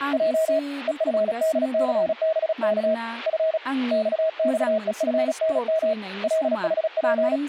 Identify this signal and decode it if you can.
Morse code, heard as a keyed tone, hand-sent with a paddle, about 36 wpm, 640 Hz, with speech in Bodo. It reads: J EFDCBK F XXEFNM LHP